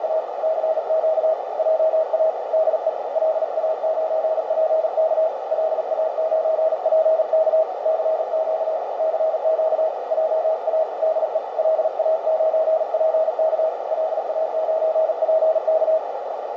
Morse code, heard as a keyed tone, hand-sent with a paddle, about 38 wpm, 640 Hz, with heavy radio static and a narrow filter. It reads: … CQ JA DE LA9PK LA9PK CQ CQ JA DE LA9PK LA9PK